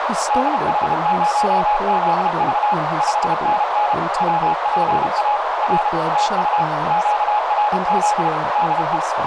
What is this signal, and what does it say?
Morse code, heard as a keyed tone, machine-sent, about 32 wpm, 840 Hz, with heavy radio static, a narrow filter and speech in English. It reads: DH0ZV 5NN WPA R TU QRZ DE